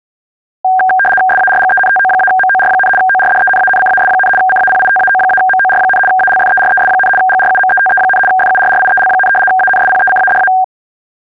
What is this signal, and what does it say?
RTTY (75 baud, 850 Hz shift), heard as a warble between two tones, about 1170 Hz centre. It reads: SARGENTO-MOR, ORDENANCAS, CAPITAO-MOR, ALFERES, GRUMETE, FURRIEL, ANSPECADA